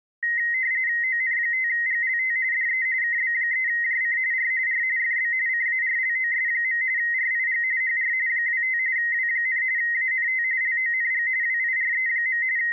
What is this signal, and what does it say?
RTTY (45.45 baud, 170 Hz shift), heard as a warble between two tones, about 1950 Hz centre. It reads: ON5GLT DE KB3JC R R FB CARLOS. RIG HR 25 W, ANT LONG WIRE. …